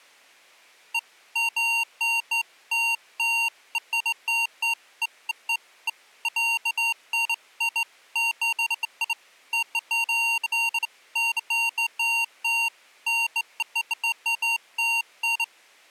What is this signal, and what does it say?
Beeps of irregular length. There is no code.